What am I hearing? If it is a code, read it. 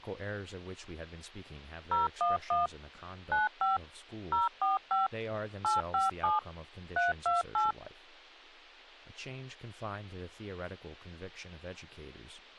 DTMF, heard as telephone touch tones, dialled by machine, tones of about 160 ms, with speech in English. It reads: 011 95 045 857 328